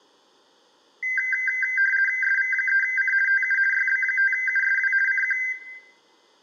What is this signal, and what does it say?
RTTY (50 baud, 450 Hz shift), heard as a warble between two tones, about 1800 Hz centre, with room echo. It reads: SV3C TU YB5USW CQ